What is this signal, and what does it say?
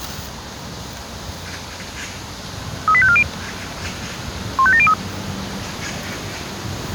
Five-tone selective call (ZVEI), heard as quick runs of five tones, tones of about 70 ms, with the noise of a park. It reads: 38540 15703